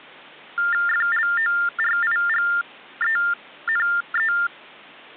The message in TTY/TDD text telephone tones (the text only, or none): FLORIGENE